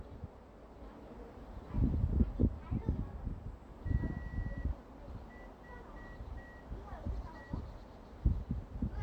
Morse code, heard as a whistle, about 6 wpm, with room echo and the noise of a residential street. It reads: THE